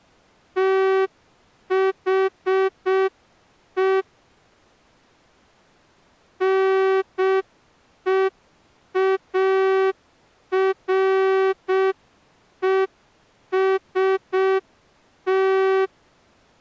Morse code, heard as a horn, hand-sent with a straight key, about 6 wpm. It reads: THE NEAREST